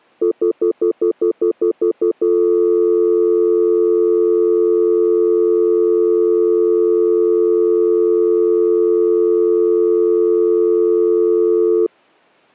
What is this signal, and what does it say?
Telephone call progress tone (North American plan), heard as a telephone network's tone, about 350, 440 Hz, 0.1 s on and 0.1 s off. Stutter dial tone.